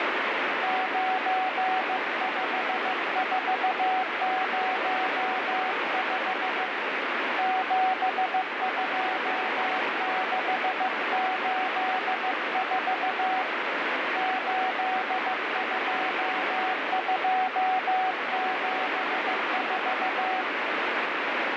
Morse code, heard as a keyed tone, hand-sent with a paddle, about 15 wpm, 750 Hz, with heavy radio static. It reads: 95405 72684 82274